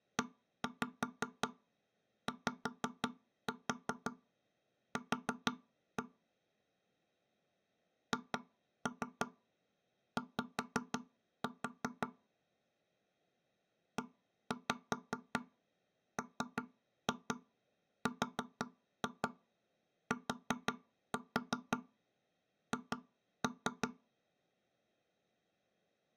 Tap code, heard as knocks on wood, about 5 knocks a second. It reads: EYQ HY EMRTH